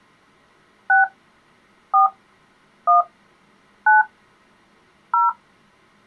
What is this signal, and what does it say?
DTMF, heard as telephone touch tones, dialled by hand, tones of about 150 ms. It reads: 6 4 1 9 0